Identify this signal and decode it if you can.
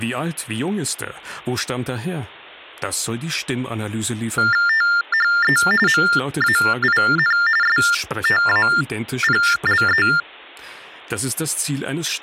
TTY/TDD text telephone tones (45.45 baud Baudot), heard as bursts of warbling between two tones, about 400 Hz shift, 1600 Hz centre, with speech in German. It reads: THE MAIN STAPLE